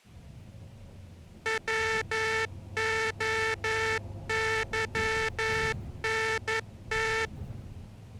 Morse code, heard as a buzzer, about 11 wpm, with the noise inside a bus. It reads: WOYNT